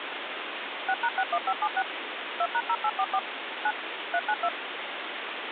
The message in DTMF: 6#61576 2#0844 9 392

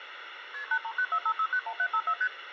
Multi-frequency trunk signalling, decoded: KP 83945691754 ST

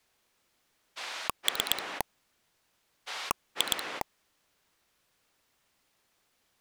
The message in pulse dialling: 3 2

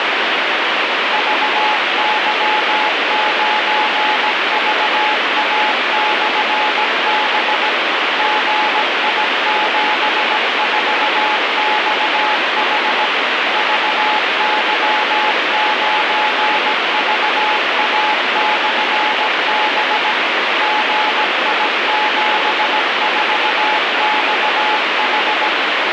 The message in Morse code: VY9VA/B GI74XH VY9VA/B GI74XH

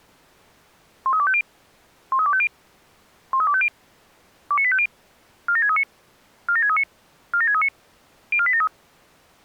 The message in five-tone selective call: 13250 13250 13250 29850 47639 47639 47639 04873

